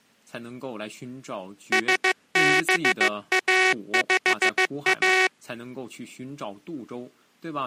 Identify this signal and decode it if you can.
Morse code, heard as a buzzer, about 15 wpm. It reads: SBA5A